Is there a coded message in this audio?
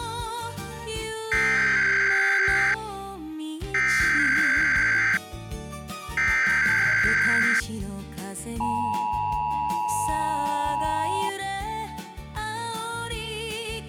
Yes: Emergency Alert System (SAME) tones (header bursts, then the 853 and 960 Hz attention tone) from 1.3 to 11.3 s, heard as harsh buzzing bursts, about 520.83 baud.